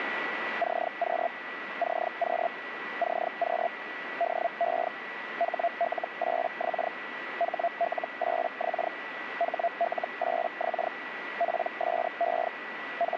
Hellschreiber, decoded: CQ CQ CQ DE HL8X HL8X HL8X PSE …

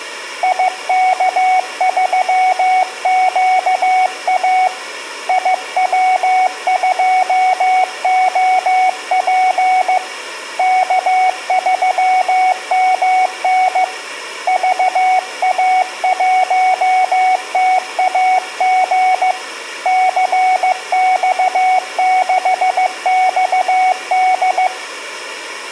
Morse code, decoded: IK3QA IW2OP K3MN VA1TAG CX6XD

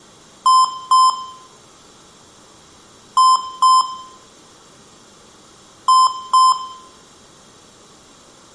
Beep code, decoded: 2 short

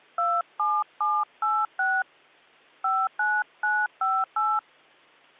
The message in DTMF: 27786 59958

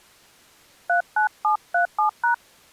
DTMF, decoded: 39737#

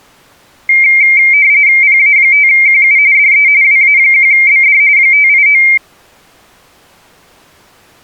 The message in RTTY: PA5QU DE WA1BD 589

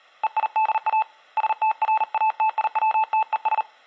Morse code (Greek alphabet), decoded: ΕΙΔΑ ΣΤΡΑΤΙΩΤΕΣ

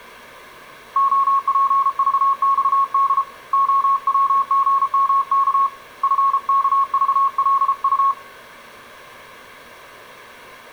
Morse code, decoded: OPVXD OWGMK FKVLU

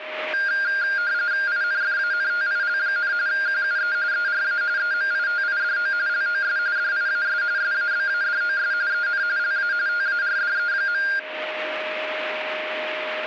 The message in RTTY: INFANTIL, QUE ERA EMITIDO LOS DIAS SABADOS EN LA TARDE.

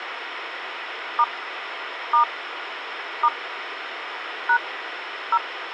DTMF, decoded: * * * # 0

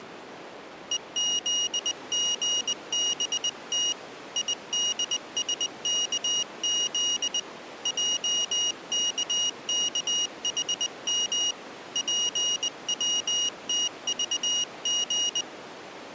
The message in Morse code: EZGBT IDSKZ JKKHM PWTVG

